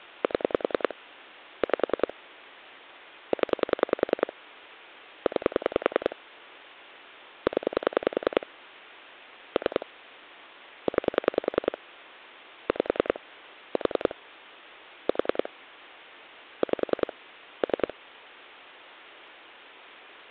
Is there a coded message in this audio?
Yes: pulse dialling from 0.2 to 17.9 s, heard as clicks on a phone line, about 10 pulses a second. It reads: 7 5 0 9 0 3 9 5 4 4 5 3